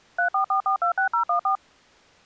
DTMF, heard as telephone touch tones, dialled by machine, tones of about 100 ms. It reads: 344426014